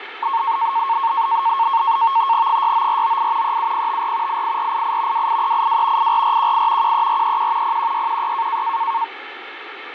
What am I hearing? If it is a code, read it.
NAVTEX (SITOR-B), 100 baud, 170 Hz shift, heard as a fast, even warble, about 1000 Hz centre, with radio static. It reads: 69498 37054 88488 28382 84418 13431 01616